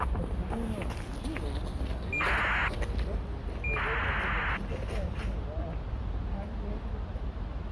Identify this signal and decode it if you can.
ACARS aircraft data, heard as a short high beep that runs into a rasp, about 2400 baud, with the noise of a park.